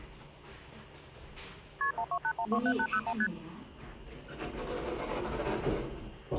Multi-frequency trunk signalling (R1, as on North American trunks), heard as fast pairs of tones, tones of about 70 ms, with the noise inside a lift. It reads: KP 128127801 ST